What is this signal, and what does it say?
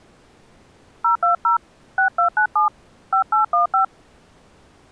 DTMF, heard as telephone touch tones, dialled by hand, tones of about 110 ms. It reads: 020 6297 5815